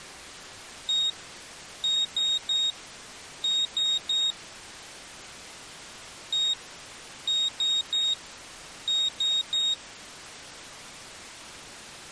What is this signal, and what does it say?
Beep code, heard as a piezo beeper, played twice, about 3750 Hz. 1-3-3. In Phoenix BIOS tables: chip or data line failure in the first 64 KB of memory.